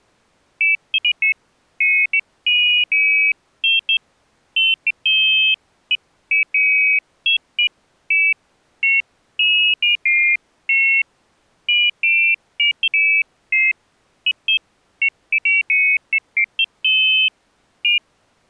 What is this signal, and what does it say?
Pairs of high tones at irregular times. There is no code.